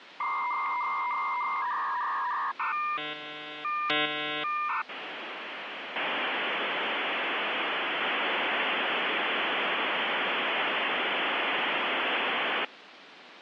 Dial-up modem handshake (V.34 or later), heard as a whistle, warbles, then hiss, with phone line noise.